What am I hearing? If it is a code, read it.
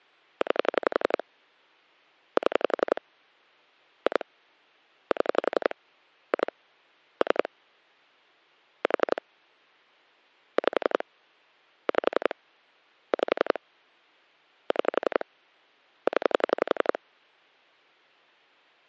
Pulse dialling, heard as clicks on a phone line, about 11 pulses a second. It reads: 9 7 2 7 2 3 4 5 5 5 6 0